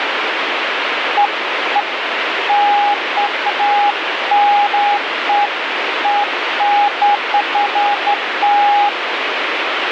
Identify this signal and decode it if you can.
Beeps of irregular length, with radio static. There is no code.